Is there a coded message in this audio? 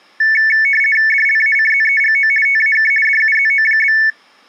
Yes: RTTY (50 baud, 450 Hz shift) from 0.2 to 4.1 s, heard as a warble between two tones, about 2000 Hz centre. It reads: DLACZEGO TAK DUZO?